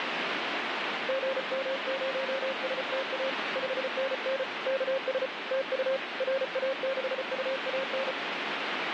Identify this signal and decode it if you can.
Morse code, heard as a keyed tone, hand-sent with a paddle, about 34 wpm, 540 Hz, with radio static. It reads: GM0STA 5NN KS TU RA6UAN